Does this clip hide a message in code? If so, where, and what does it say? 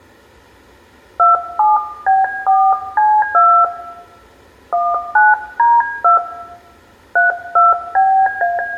Yes: DTMF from 1.2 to 8.6 s, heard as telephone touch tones, dialled by hand, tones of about 220 ms, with room echo. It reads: 27B4C2 19D2 32BA